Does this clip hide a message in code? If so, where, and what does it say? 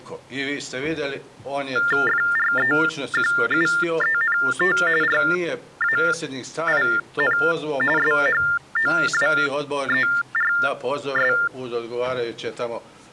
Yes: TTY/TDD text telephone tones (45.45 baud Baudot) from 1.8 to 11.5 s, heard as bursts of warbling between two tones, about 400 Hz shift, 1600 Hz centre. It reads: FREQUENT RAIN SHOWERS